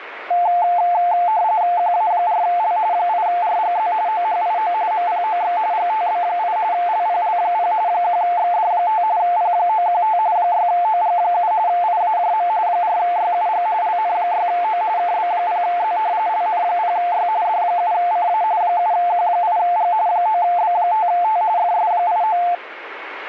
RTTY (45.45 baud, 170 Hz shift), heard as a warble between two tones, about 790 Hz centre, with radio static. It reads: QA4L 8RGZ OHIO MPOX GTB8 LPL0 1XD5 P915 6OG7 IAJM 4YUG LN6O KB0Z LN0Y D7CA 7Q8G 9B5T FS89